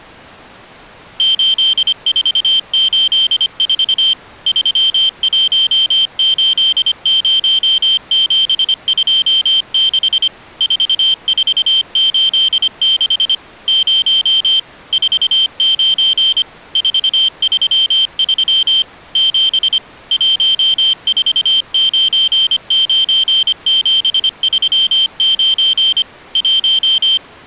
Morse code, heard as a high beeper, machine-sent, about 25 wpm, 3150 Hz. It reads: 8484 3180726 4486 0 49 433 7 1499739 1